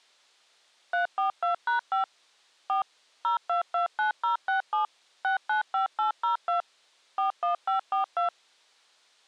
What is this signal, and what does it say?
DTMF, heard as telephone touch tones, dialled by machine, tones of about 120 ms. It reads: 342#5 4 0229067 695802 41542